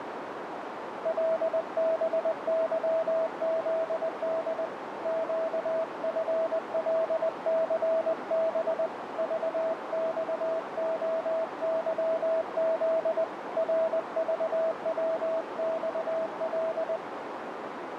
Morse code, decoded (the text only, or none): LBYZD QFLCB VXOYZ RVWXL